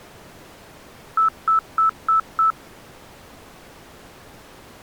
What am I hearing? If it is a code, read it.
Beep code, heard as beeps, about 1310 Hz. 5 short. In AMI BIOS tables: processor failure; in Dell tables: CMOS battery failure.